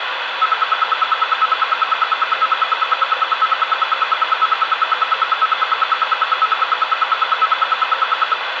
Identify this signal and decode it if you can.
Radio time signal (RWM, Moscow), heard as ten pulses a second, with radio static and room echo.